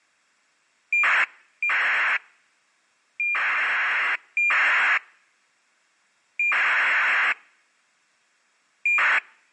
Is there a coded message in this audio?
Yes: ACARS aircraft data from 0.9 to 9.2 s, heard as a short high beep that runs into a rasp, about 2400 baud.